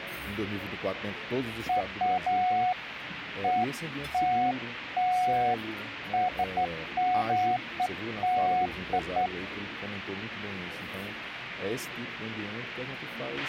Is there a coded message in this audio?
No, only beeps of irregular length, with a squelch burst at the end.